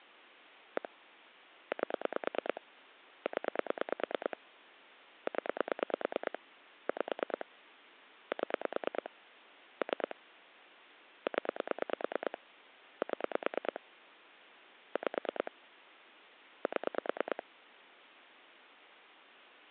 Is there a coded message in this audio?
Yes: pulse dialling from 0.8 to 17.4 s, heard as clicks on a phone line, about 9 pulses a second. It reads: 1 8 0 0 5 7 3 0 7 5 7